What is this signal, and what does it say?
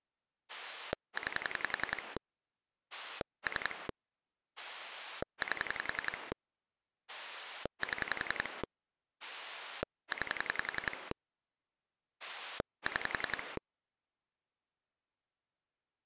Pulse dialling, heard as a rotary dial, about 11 pulses a second. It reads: 9 3 8 7 9 6